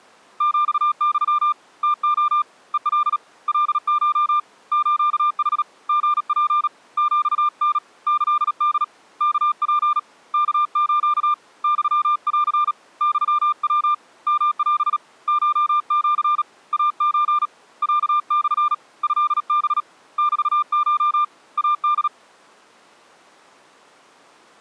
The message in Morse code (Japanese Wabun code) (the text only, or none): ヒユ ムレ ヘカ カコ スヌ リツ ヒタ キホ ワツ ワス ユン ユヤ ヨオ コシ イソ ロモ トハ メコ イホ